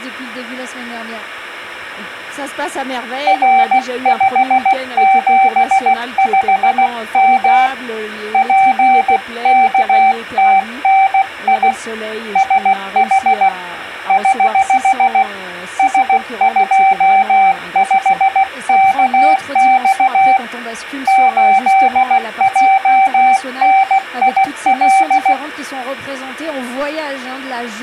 Morse code, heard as a keyed tone, hand-sent with a paddle, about 16 wpm, 770 Hz. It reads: R575M PKTNI SH <HH> S25KX 8JNIL